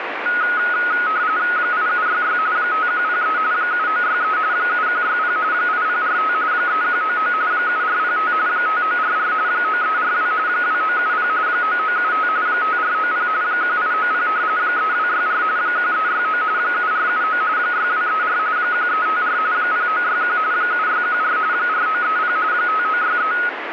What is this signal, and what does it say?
RTTY (45.45 baud, 170 Hz shift), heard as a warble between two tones, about 1360 Hz centre, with radio static. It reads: 8766 5103 7963 7160 8045 3199 7405 5944 9342 2970 9975 5490 1890 3264 1369 7479 6234 1354 0961 7614 4930 5963